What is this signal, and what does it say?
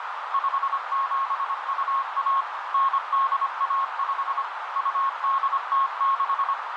Morse code (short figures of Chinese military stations), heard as a keyed tone, machine-sent, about 25 wpm, 1090 Hz, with heavy radio static and a narrow filter. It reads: 5721 9815 2806